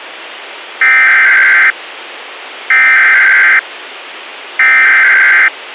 Emergency Alert System (SAME) tones (header bursts), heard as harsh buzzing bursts, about 520.83 baud, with radio hiss.